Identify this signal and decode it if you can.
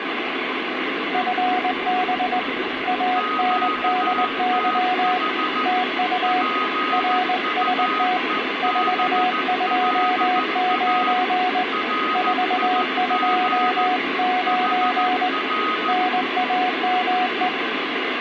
Morse code, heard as two keyed tones, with radio static and room echo. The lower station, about 20 wpm, 730 Hz: FB ANDY TU RST 429 429 NAME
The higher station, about 14 wpm, 1250 Hz: QTH PUEBLA RIG HR